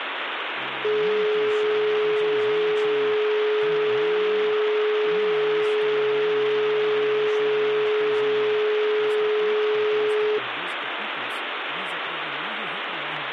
Telephone call progress tone (425 Hz plan, as in most of Europe), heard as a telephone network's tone, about 420 Hz, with phone line noise. Dial tone.